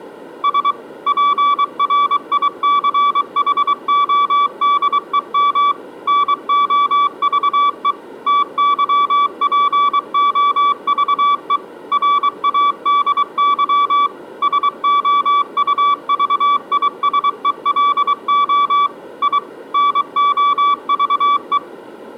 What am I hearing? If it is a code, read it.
Morse code, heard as a keyed tone, machine-sent, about 23 wpm, 1150 Hz. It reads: S PRICHODEM NOVE TYPOVE RADY SOUVISELO I NOVE